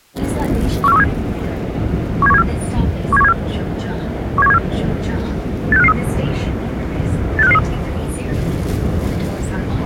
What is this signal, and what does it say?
Five-tone selective call (EEA), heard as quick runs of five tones, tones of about 40 ms, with the noise inside a subway train. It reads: 14137 17174 17174 17174 86553 86553